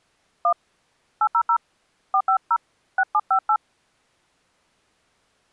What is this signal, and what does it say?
DTMF, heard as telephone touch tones, dialled by hand, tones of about 70 ms. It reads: 1 800 450 6758